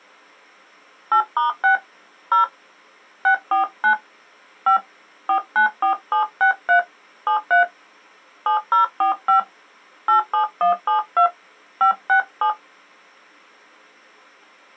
DTMF, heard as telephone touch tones, dialled by hand, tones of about 110 ms. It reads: 8*6 0 649 5 494763 73 7045 87172 567